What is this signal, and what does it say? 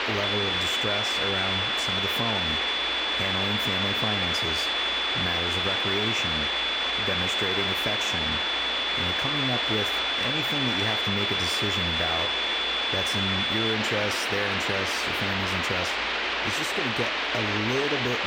A steady tone, with radio static and speech in English. There is no code.